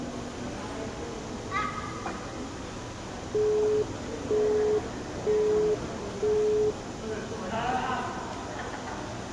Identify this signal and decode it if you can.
Telephone call progress tone (single-tone plan, as in Europe, Japan and elsewhere), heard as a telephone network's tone, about 420 Hz, 0.48 s on and 0.48 s off, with room echo and the noise of a crowd indoors. Busy tone.